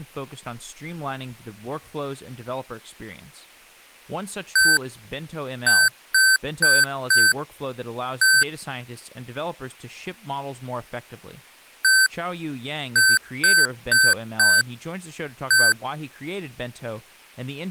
Beep code, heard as beeps from a small speaker, played twice, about 1550 Hz, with speech in English. 1-4-1. In Phoenix BIOS tables: address line failure in the first 64 KB of memory.